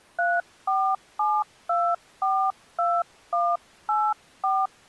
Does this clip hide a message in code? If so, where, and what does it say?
Yes: DTMF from 0.2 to 4.7 s, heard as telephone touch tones, dialled by hand, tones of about 240 ms. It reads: 347242184